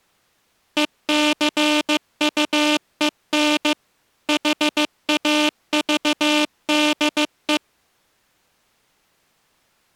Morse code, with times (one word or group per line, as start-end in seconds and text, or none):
0.8-3.7 ECUEN
4.3-7.6 HAVDE